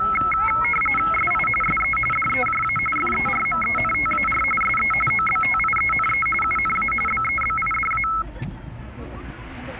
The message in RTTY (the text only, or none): SI SE DEJA FERMENTAR SE OBTIENE UNA BEBIDA